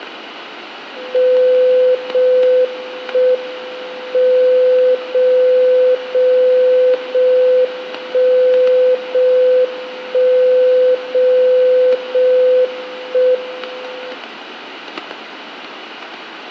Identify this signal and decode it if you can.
Radio time signal (JJY), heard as a tone whose level steps once a second, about 510 Hz, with static crashes and room echo. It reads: 0 1 M 0 0 0 1 0 1 0 0 1 M